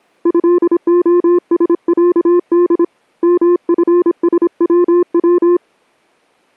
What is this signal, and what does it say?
Morse code (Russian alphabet), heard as a keyed tone, hand-sent with a paddle, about 26 wpm, 350 Hz. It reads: ЭОСЯД МФСВВ